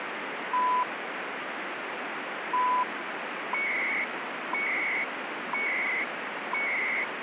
Radio time signal (CHU, Canada), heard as beeps and data bursts, one a second, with radio static.